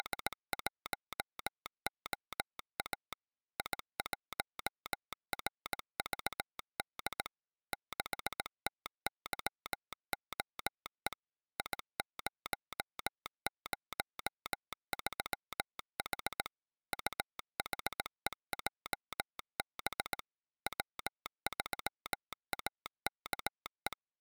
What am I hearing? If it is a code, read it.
Morse code, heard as a telegraph sounder, machine-sent, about 18 wpm. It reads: … I1RVD 6TYOE I003H UHEJB W3AKE